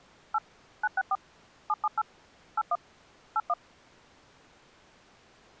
DTMF, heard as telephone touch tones, dialled by machine, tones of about 40 ms. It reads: 8 964 778 81 81